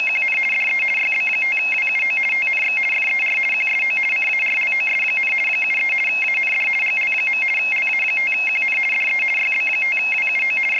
RTTY (50 baud, 450 Hz shift), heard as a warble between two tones, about 2350 Hz centre. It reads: … DE YB5WUO TNX FER QSO CARLOS, 73 AND GL. LA5QN DE YB5WUO …